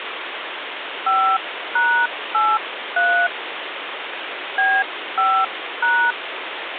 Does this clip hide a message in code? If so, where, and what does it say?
Yes: DTMF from 1.1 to 6.1 s, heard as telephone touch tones, dialled by hand, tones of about 270 ms, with phone line noise. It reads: 5#83 B5#